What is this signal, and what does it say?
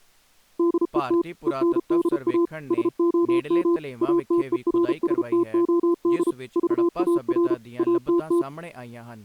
Morse code, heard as a keyed tone, machine-sent, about 33 wpm, 340 Hz, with speech in Punjabi. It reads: DET ENDA SOM ATERSTOD VAR ATT